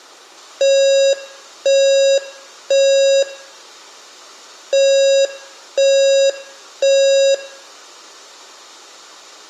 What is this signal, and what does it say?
Alarm pattern, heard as an alarm's beeps, played twice, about 550 Hz, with room echo. Temporal three. Smoke or fire, evacuate.